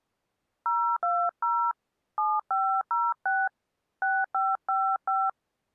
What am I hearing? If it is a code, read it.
DTMF, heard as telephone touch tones, dialled by hand, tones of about 230 ms. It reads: 020 7506 6555